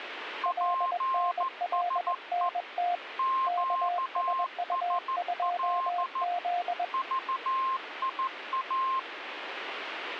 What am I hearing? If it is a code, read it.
Morse code, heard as two keyed tones, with radio static. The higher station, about 14 wpm, 1060 Hz: PSE QSL VIA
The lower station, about 21 wpm, 710 Hz: LNLNT KSU2Z